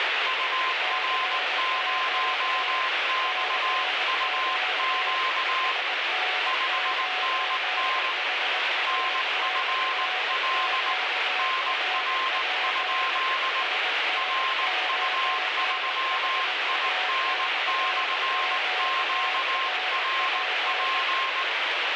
Morse code, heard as two keyed tones, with heavy radio static. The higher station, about 19 wpm, 1050 Hz: UR0XUQ 5NN NFL NR? RU3IN/QRP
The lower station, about 20 wpm, 740 Hz: CQ CQ SN9HA/QRP SN9HA/QRP